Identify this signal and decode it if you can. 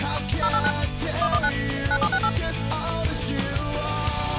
DTMF, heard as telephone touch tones, dialled by machine, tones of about 60 ms. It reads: 089 119 9768